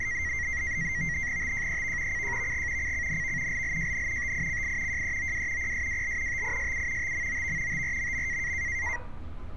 NAVTEX (SITOR-B), 100 baud, 170 Hz shift, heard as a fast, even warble, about 2000 Hz centre, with street noise. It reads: TJEV CJVG CCNV LLJN TICI JEOW PSWL TISU TMOV TRMM